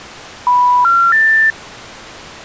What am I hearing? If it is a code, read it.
Telephone call progress tone (North American plan), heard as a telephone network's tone, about 980, 1370, 1800 Hz. Special information tone.